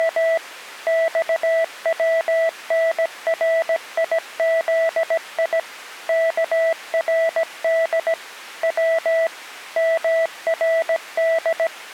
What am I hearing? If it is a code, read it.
Morse code (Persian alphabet), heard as a keyed tone, machine-sent, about 17 wpm, 660 Hz. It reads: … خونریزی کرد و مرد